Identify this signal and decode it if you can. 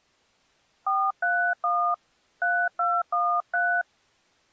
DTMF, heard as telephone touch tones, dialled by hand, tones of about 270 ms. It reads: 431 3213